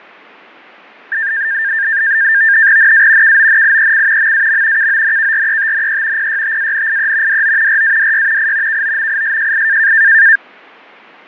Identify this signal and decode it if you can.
NAVTEX (SITOR-B), 100 baud, 170 Hz shift, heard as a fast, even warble, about 1700 Hz centre, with fading. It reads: NA KONIEC MAM KONKRETNE PYTANIE DO RADY I KOMISJI